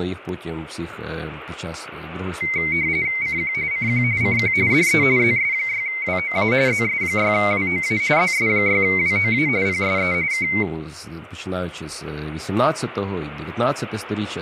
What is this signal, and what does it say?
RTTY (45.45 baud, 170 Hz shift), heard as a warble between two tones, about 2150 Hz centre, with speech in Ukrainian. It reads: CQ CQ CQ DE ZS6WOA ZS6WOA ZS6WOA PSE K